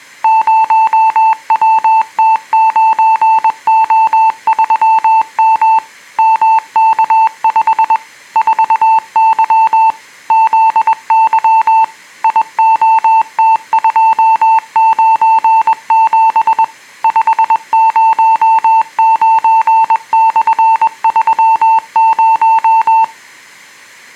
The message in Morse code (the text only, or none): 0WT9O3M MK5 4Y ZY IOT297 509/30